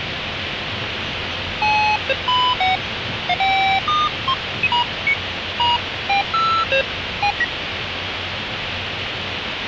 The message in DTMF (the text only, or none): none